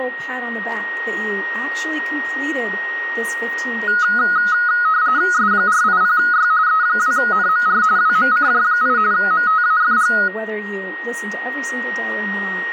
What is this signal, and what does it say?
RTTY (45.45 baud, 170 Hz shift), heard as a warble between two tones, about 1360 Hz centre, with a steady whistle near 1870 Hz. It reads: S480Y E2NMR WMCJ8 MTAFG